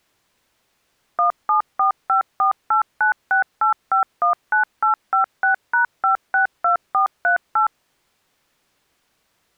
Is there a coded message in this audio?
Yes: DTMF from 1.2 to 7.7 s, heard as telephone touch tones, dialled by machine, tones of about 120 ms. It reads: 174548968519856#562438